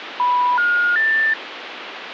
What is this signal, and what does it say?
Telephone call progress tone (North American plan), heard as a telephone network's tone, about 980, 1430, 1800 Hz, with phone line noise. Special information tone.